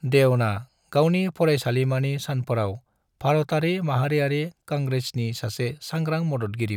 Speech in Bodo. There is no code.